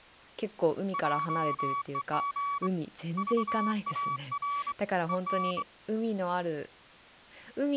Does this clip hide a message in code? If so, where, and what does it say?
Yes: Morse code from 0.9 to 5.7 s, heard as a keyed tone, hand-sent with a straight key, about 23 wpm, 1140 Hz, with speech in Japanese. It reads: JEG VAR EN